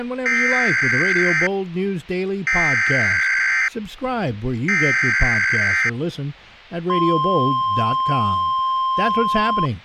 Emergency Alert System (SAME) tones (header bursts, then the 1050 Hz attention tone), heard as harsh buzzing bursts, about 520.83 baud, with speech in English.